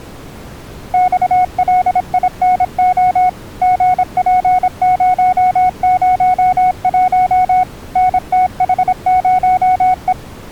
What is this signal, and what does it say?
Morse code, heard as a keyed tone, machine-sent, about 26 wpm, 740 Hz. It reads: XLINO GP001 NTH0E